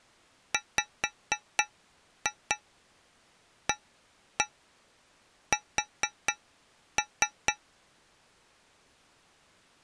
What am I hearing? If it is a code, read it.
Tap code, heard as taps on a metal pipe, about 4 knocks a second. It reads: WAS